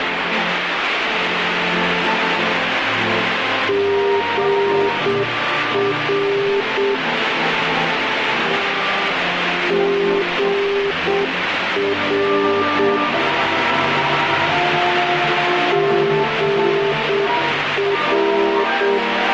Morse code, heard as a keyed tone, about 7 wpm, 400 Hz, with radio static. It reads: GR GR GR